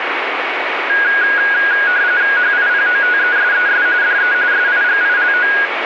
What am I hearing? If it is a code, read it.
RTTY (45.45 baud, 170 Hz shift), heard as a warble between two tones, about 1550 Hz centre, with radio static. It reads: HIPOTESES DE SIGILO